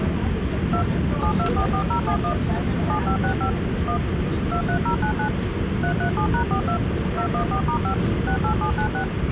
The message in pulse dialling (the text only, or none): none